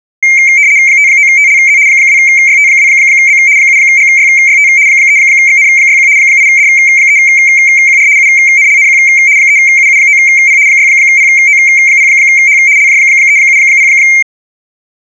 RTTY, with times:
0.9-1.8 59TLZ
1.9-3.4 2YT2B
3.6-4.7 7GYYT
4.9-6.1 3XN61
6.2-8.1 8D3QR
8.2-9.0 UNLNQ
9.4-10.6 3UU9P
10.7-12.6 6PO0H
12.8-13.9 LJ370

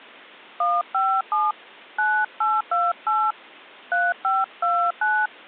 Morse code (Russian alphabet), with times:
none

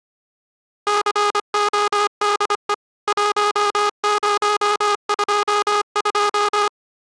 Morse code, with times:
0.9-2.7 CODE
3.1-6.7 1022

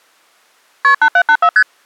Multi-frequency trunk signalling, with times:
0.8-0.9 KP
1.0-1.5 8784
1.6-1.6 ST

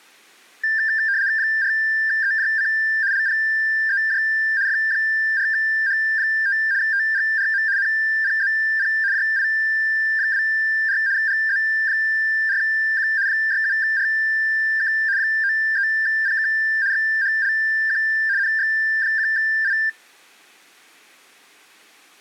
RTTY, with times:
1.4-2.7 4EJC
3.1-4.2 LPEJ
4.7-6.6 F4H5
6.8-7.6 TGRM
7.8-8.9 NPZP
9.1-11.0 JI24
11.2-13.1 GZ4Q
13.3-14.9 67RK
15.2-16.5 93PK
16.9-18.0 XHLQ
18.4-19.7 NX1I

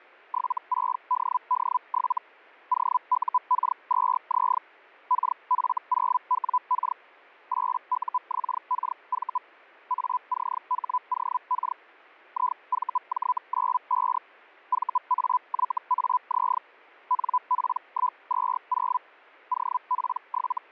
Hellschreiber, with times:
0.3-2.2 76DD7
2.7-4.6 OUK2Z
5.1-7.0 KF0WK
7.5-9.4 8UXKV
9.9-11.8 ACHOK
12.3-14.2 IVJ95
14.7-16.6 VAYAZ
17.1-19.0 NP120
19.5-20.7 …

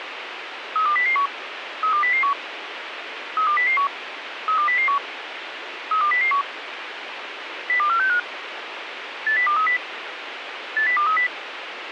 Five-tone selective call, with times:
0.8-1.3 32001
1.8-2.3 32001
3.4-3.9 32001
4.5-5.0 32001
5.9-6.4 32001
7.7-8.2 02465
9.3-9.8 80230
10.8-11.3 80230

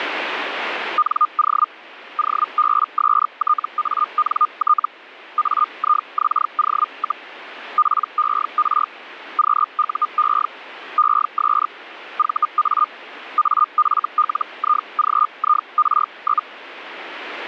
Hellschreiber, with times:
1.0-1.7 NO
2.2-4.9 OBSTANT
5.4-7.3 AIXO,
7.8-8.9 PER
9.4-10.5 QUE
11.0-11.7 ES
12.2-12.9 VA
13.4-16.5 AFLIGIR?

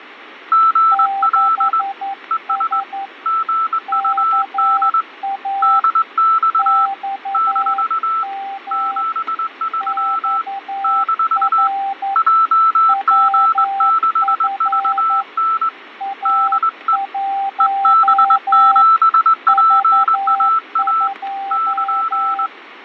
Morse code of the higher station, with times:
0.5-1.8 GL
2.3-2.8 ES
3.3-5.0 GUD
5.6-6.9 DX
7.3-8.2 -
8.7-10.4 73
10.8-11.7 -
12.2-15.7 JG6VN
16.3-17.0 DE
17.6-21.1 EB7PAA
21.5-22.5 <KN>

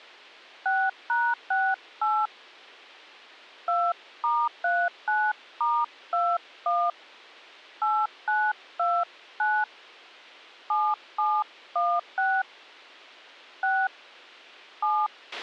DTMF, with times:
0.7-2.3 6#68
3.7-6.9 2*39*21
7.8-9.6 8929
10.7-12.4 7716
13.6-13.9 6
14.8-15.1 7

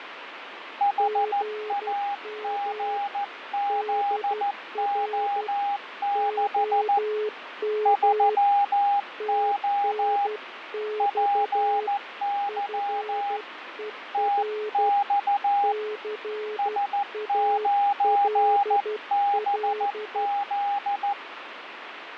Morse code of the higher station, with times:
0.8-7.0 HAGZO6
7.9-10.3 3O
11.0-13.4 PY
14.1-15.7 TX
16.6-21.1 S9BZ

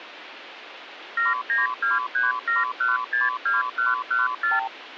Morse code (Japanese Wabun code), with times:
none

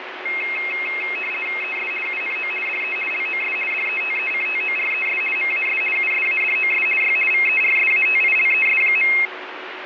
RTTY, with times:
1.6-1.9 ES
2.1-2.5 UNO
2.7-3.0 DE
3.1-3.6 LOS
3.7-5.2 DETECTORES
5.4-5.8 MAS
6.0-6.9 USADOS
7.0-7.2 Y
7.3-9.1 VERSATILES.

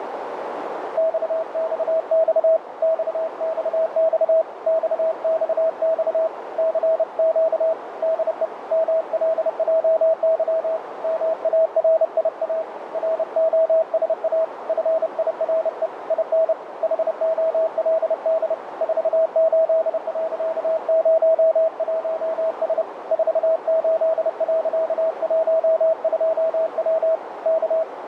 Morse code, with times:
1.0-2.6 XXX
2.8-4.4 XXX
4.7-6.3 XXX
6.6-7.7 CQ
8.0-8.5 DE
8.7-10.8 MLJY
11.0-12.6 MARIA
12.9-14.4 ROSA
14.7-15.9 FIRE
16.1-16.5 IN
16.8-18.5 HOLD
18.8-22.8 48.01S
23.1-27.2 48.12W
27.5-27.8 K

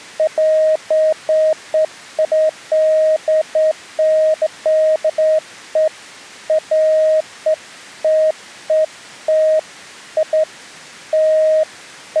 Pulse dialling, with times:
none

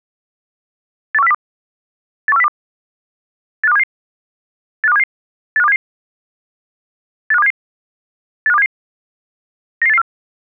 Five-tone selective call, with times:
1.1-1.3 81402
2.3-2.5 81402
3.6-3.8 85277
4.8-5.0 85277
5.6-5.8 85277
7.3-7.5 85277
8.5-8.7 85277
9.8-10.0 99884

